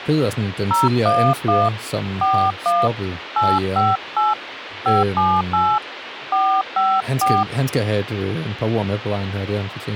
DTMF, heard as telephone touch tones, dialled by hand, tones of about 230 ms, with phone line noise and speech in Danish. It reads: 011 41 858 578 454